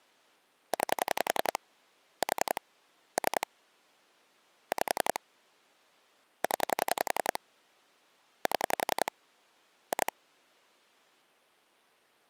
Pulse dialling, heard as clicks on a phone line, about 11 pulses a second. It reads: 9 4 3 5 0 7 2